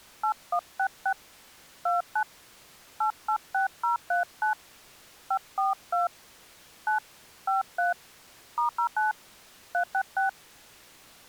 DTMF, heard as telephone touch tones, dialled by hand, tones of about 110 ms. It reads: 8166 29 886039 542 9 53 *09 366